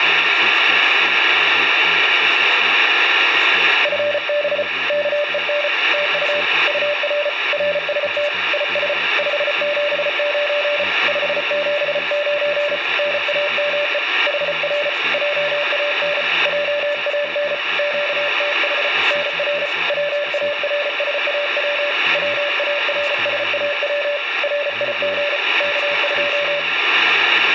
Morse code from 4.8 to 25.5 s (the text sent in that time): KEN TU UR RST IS 579 579 NAME HR JAN JAN QTH NR WARSAW WARSAW RIG